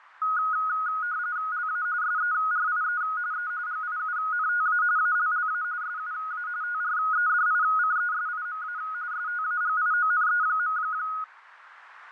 RTTY (45.45 baud, 170 Hz shift), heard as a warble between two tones, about 1360 Hz centre, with radio static. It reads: LA SERIE E GIUNTA ALLA SUA TREDICESIMA STAGIONE.